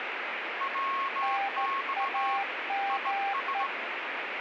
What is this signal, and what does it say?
Morse code, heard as two keyed tones, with radio static. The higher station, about 17 wpm, 1090 Hz: WX IS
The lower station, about 14 wpm, 790 Hz: NAME